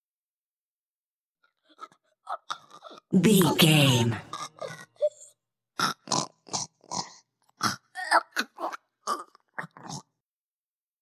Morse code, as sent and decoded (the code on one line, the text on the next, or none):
none